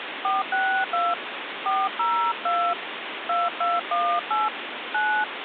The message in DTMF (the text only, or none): 462 402 2218 9